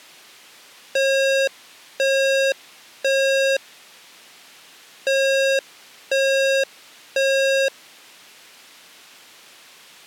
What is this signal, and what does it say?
Alarm pattern, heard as an alarm's beeps, played twice, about 540 Hz. Temporal three. Smoke or fire, evacuate.